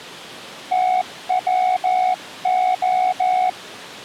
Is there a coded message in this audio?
Yes: Morse code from 0.7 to 3.6 s, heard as a keyed tone, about 14 wpm, 740 Hz. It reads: TWO